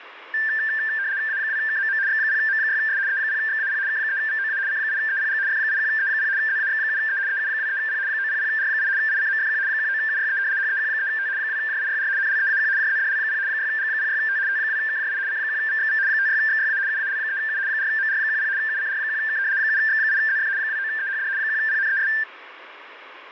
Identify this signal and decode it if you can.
RTTY (75 baud, 170 Hz shift), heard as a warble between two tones, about 1700 Hz centre, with radio static. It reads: A2KMM X0M6S E0XAP K3VOA C8EPG F81E0 ZAX7E EU23P 900R8 ICMFQ 19UYE HEQ3T 2JIYR NLEAQ JZDL0 6G06T T2KJI C1VXV 56XYA UAL3U 4MR10 UCR1K 7X8ZF 29EHD 1PNES